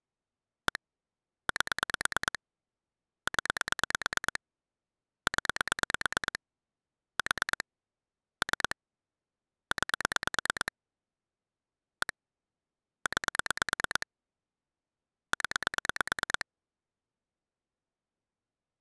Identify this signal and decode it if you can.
Pulse dialling, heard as clicks on a phone line, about 9 pulses a second. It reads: 1 8 0 0 4 3 9 1 9 0